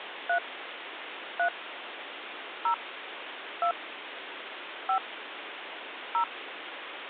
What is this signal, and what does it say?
DTMF, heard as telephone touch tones, dialled by hand, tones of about 90 ms, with phone line noise. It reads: 3 3 0 2 5 0